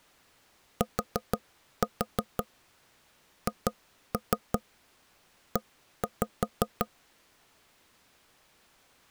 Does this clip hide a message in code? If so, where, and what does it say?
Yes: tap code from 0.8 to 6.9 s, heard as knocks on wood, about 5 knocks a second. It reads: THE